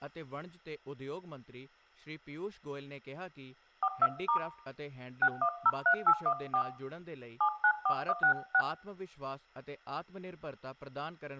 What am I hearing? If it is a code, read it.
DTMF, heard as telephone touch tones, dialled by hand, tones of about 70 ms, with room echo and speech in Punjabi. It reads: 42* 6103814 794166